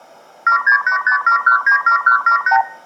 Multi-frequency trunk signalling (R2, with the far end's replies), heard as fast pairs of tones, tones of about 100 ms, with room echo. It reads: 76857197178